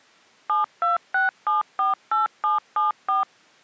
DTMF, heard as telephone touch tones, dialled by machine, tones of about 150 ms. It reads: 726748774